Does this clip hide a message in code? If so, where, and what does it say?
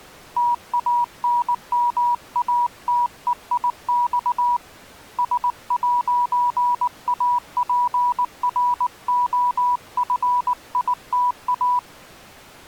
Yes: Morse code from 0.3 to 11.8 s, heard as a keyed tone, hand-sent with a paddle, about 19 wpm, 970 Hz. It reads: TANMATEIX S'APROFITA